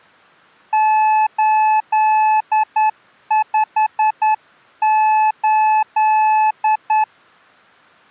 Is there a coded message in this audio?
Yes: Morse code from 0.7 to 7.1 s, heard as a keyed tone, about 10 wpm, 860 Hz. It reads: 858